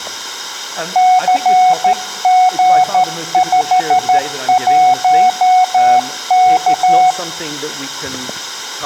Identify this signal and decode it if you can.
Morse code, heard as a keyed tone, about 13 wpm, 740 Hz, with room echo. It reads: CG51K